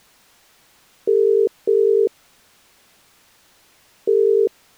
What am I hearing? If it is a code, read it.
Telephone call progress tone (as in the UK, Ireland, Australia and similar networks), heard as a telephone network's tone, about 400, 450 Hz. Ringback tone.